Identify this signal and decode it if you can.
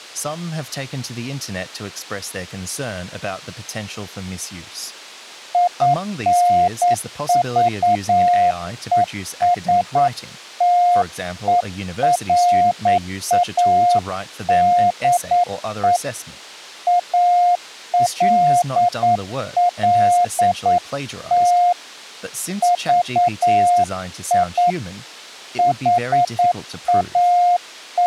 Morse code, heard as a keyed tone, hand-sent with a paddle, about 9 wpm, 710 Hz, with speech in English. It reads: INVESTERADE ALLT VI …